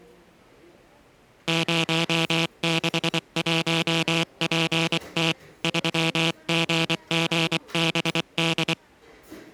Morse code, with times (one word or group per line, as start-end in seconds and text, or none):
1.5-5.3 061PT
5.6-8.7 3GGBD